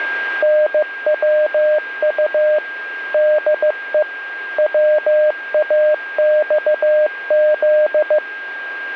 Morse code, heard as a keyed tone, machine-sent, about 15 wpm, 610 Hz, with radio static and a steady whistle near 1610 Hz. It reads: NWU DE WAXZ